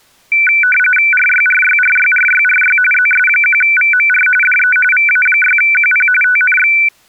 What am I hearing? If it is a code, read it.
RTTY (45.45 baud, 850 Hz shift), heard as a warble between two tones, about 1900 Hz centre. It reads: RYRYRYRYRY ZS1VMR DE VA6QP TNX